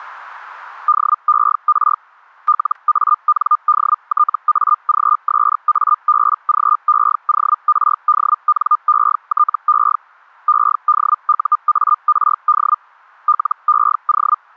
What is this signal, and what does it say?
Hellschreiber (Feld-Hell, 122.5 baud), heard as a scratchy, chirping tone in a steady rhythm, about 1210 Hz, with static crashes. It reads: DER LANDTAGSABGEORDNETE EDUARD LEO